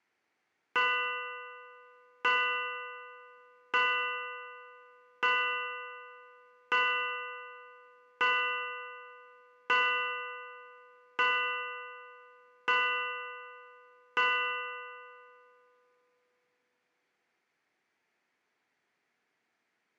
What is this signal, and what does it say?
Clock strike, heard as a bell, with room echo. 10. Ten o'clock.